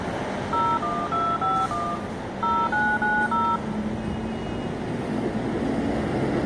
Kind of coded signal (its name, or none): DTMF